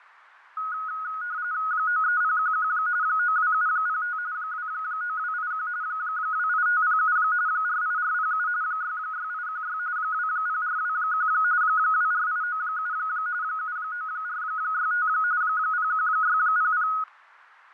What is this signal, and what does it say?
RTTY (45.45 baud, 170 Hz shift), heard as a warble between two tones, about 1360 Hz centre, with fading. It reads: 93011 92705 29281 28507 48407 66816 20421 24897 79465 01600